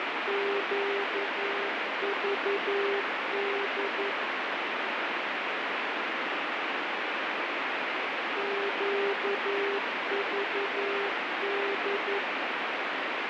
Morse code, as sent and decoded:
--.- ...- -.. / --.- ...- -..
QVD QVD

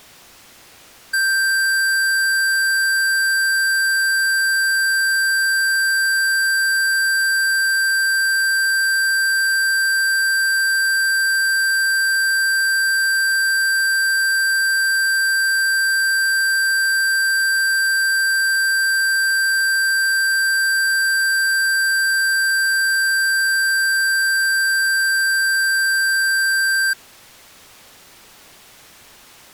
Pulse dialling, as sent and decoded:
none

